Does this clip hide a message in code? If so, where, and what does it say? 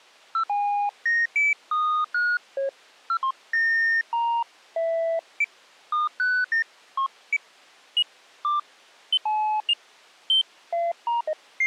No, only electronic bleeps of random pitch and length.